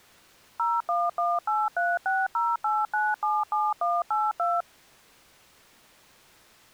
DTMF, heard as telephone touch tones, dialled by machine, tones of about 210 ms. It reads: 01183608977182